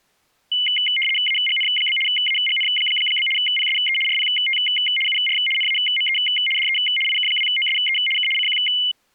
RTTY (75 baud, 850 Hz shift), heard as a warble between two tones, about 2550 Hz centre. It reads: AGN? AGN? PSE RPT UR NAME DE IK2OSE K CQ